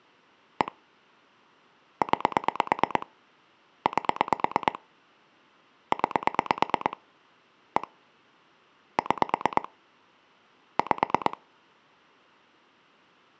Pulse dialling, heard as clicks on a phone line, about 9 pulses a second. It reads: 1 9 8 9 1 6 5